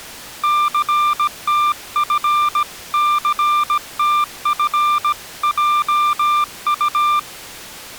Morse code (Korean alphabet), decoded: 천천히

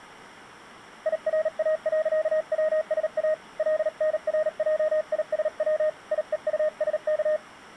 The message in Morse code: IRA.WSA LNRJISW IEUSK

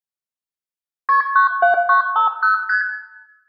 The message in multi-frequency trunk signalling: KP 97950 ST

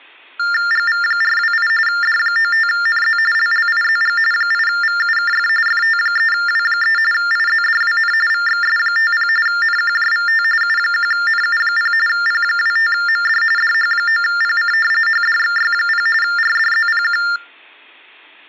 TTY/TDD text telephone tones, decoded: GV428 D95NZ LLIZG 8VUKF FT3W3 IZDWN VXS50 NQJVT U1NU0 P25MD DH9PC HDXY0 RDZPQ

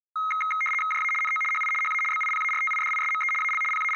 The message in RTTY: JA NO HI HA BIPARTIDISME AL …

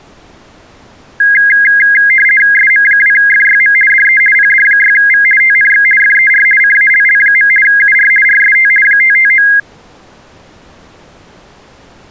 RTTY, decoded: SM2FYM DE PD6V TNX FER CALL. UR RST 559

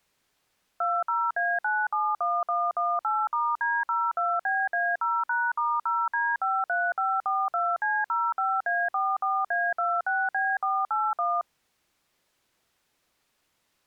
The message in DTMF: 20A971118*D02BA0#*0D53542C05A44A26B481

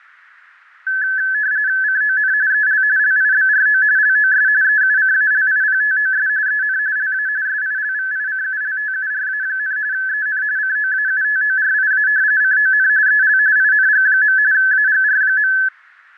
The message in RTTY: CON EL LIBRO LOS EUCALIPTOS EN LA SILVICULTURA, EN COAUTORIA CON EL ING. AGR.

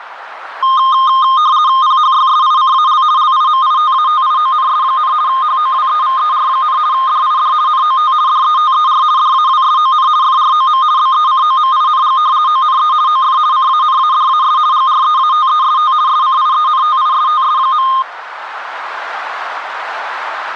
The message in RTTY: PHYSICAL LIMITATIONS, HOWEVER, DID NOT DETER DAWSON FROM BECOMING ONE OF CANADAS GREATEST SCIENTISTS.

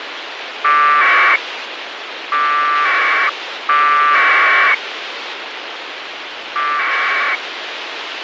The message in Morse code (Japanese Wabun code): none

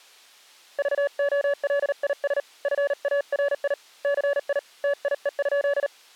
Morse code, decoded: VOLIS FARI CI TIE?

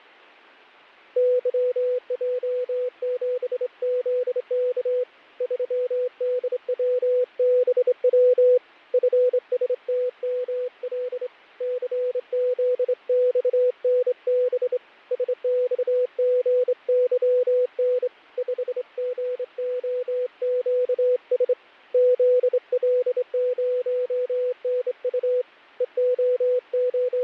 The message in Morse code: YJ7ZK 3DWBW FSTML CZXNB SXGYN 5GOQS ZL0NU …

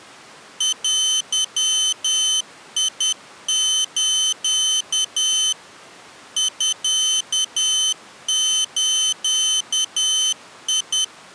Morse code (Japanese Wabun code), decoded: デス ミズ

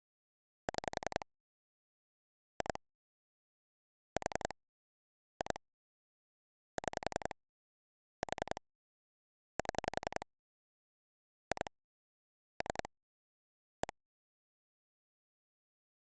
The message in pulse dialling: 6 2 4 2 6 4 7 2 3 1

